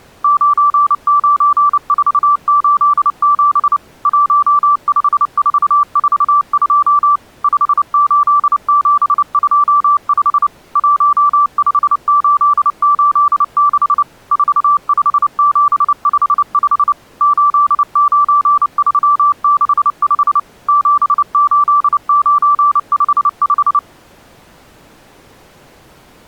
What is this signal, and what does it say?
Morse code, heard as a keyed tone, machine-sent, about 29 wpm, 1160 Hz. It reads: 99487 15442 58725 15886 45755 89365 78955